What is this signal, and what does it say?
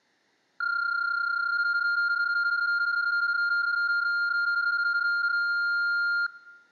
PSK31 (31.25 baud), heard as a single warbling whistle, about 1400 Hz, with room echo.